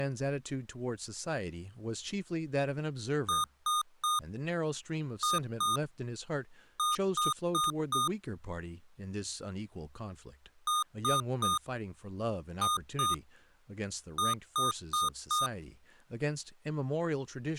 Beep code, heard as beeps from a small speaker, played twice, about 1220 Hz, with speech in English. 3-2-4. In Phoenix BIOS tables: keyboard controller failure.